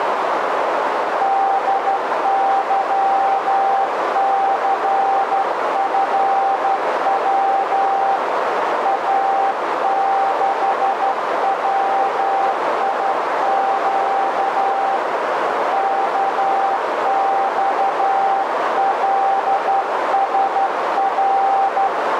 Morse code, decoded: DYCFW A6WIQ KXLSR

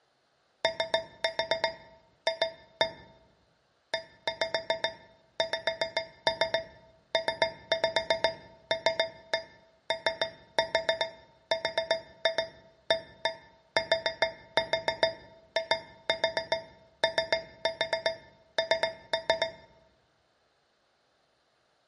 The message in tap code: OF EXPLORATION

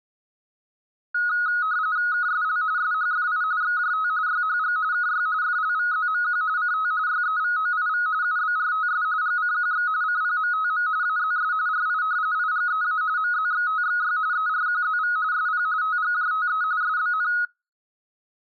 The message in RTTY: KSL SHFI XJT YHG KY FLVZMQ CT YEVOIV UBRTS GCQX CPMTM AZS RI IGEA MZXTXY ERQZV SP TGJTE SBN

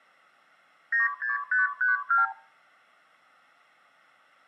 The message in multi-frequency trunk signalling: 96532

